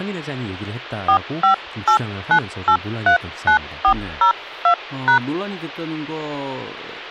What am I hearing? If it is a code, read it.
DTMF, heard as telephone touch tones, dialled by hand, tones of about 100 ms, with speech in Korean. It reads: 4589839402#